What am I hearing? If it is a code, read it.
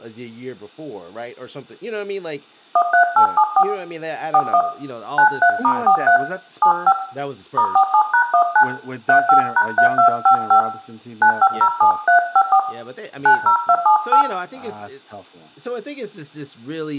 DTMF, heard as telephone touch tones, dialled by hand, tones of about 90 ms, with room echo and speech in English. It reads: 13874 41 93*43 75 *47#19 35#3255 9507354 90278